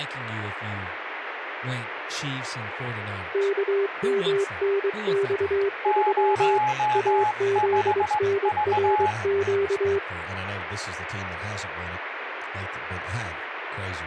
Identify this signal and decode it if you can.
Morse code, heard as two keyed tones, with radio static and speech in English. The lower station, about 23 wpm, 400 Hz: KMNX3 AZNRQ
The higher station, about 17 wpm, 850 Hz: 05V